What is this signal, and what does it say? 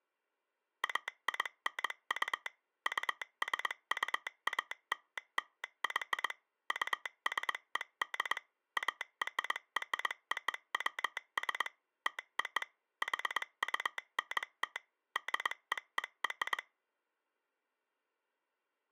Morse code (American railroad code), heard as a telegraph sounder, machine-sent. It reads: AINU USUALLY USED ARROWS TO HUNT DEER